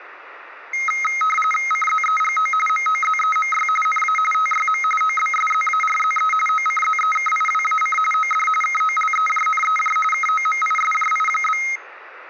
RTTY (45.45 baud, 850 Hz shift), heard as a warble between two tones, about 1700 Hz centre. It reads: CZEGO MOZEMY NA TYM OBSZARZE OCZEKIWAC OD KOLEJNEJ KOMISJI?